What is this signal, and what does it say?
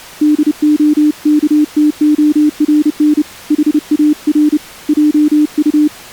Morse code, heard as a keyed tone, hand-sent with a paddle, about 30 wpm, 300 Hz. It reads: DOKTORN HAR JU